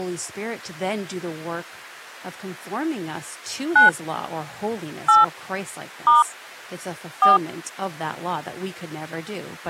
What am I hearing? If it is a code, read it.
DTMF, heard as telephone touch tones, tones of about 150 ms, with speech in English. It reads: 9 8 * 4